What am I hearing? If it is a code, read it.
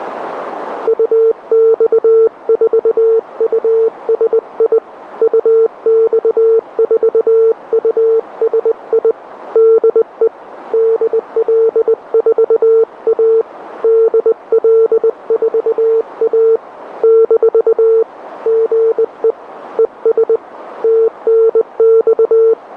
Morse code, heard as a keyed tone, hand-sent with a bug key, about 20 wpm, 450 Hz, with radio static. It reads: UX4USI UX4USI DE DL4A DL4A - GE ES TNX